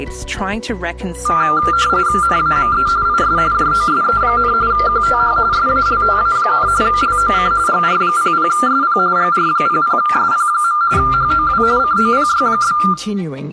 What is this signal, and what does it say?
RTTY (45.45 baud, 170 Hz shift), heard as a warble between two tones, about 1290 Hz centre, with room echo. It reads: NAME IS JOSE, QTH SALTA, LOC GR00SP GR00SP. HOW COPY?